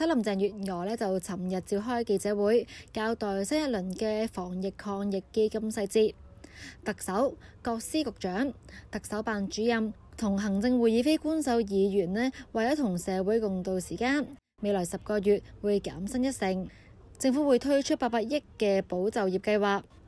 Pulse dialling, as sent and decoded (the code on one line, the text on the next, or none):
none